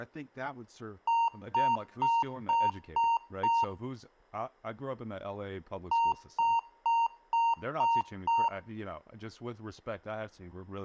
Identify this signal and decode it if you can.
Beep code, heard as beeps from a small speaker, played twice, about 920 Hz, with speech in English. 6 short. In AMI BIOS tables: keyboard controller gate A20 failure; in Dell tables: video card failure.